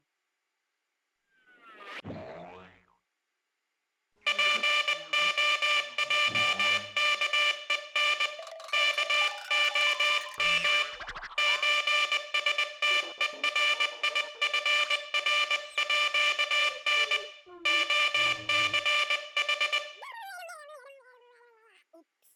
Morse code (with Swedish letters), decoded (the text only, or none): POJKEN KOM ÖSTERIFRÅN OCH